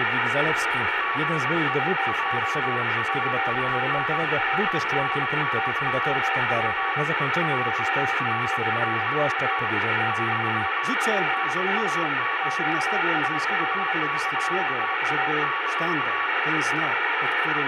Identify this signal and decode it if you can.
Morse code, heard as two keyed tones, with radio static. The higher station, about 22 wpm, 1130 Hz: GE JUAN TNX FER RPT - NAME TAKA -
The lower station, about 26 wpm, 770 Hz: WX COLD TEMP 19C - PSE QSL VIA